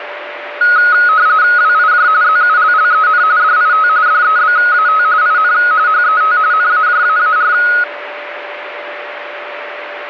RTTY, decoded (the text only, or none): WIJ ZULLEN DIT DEBAT IN HET NAJAAR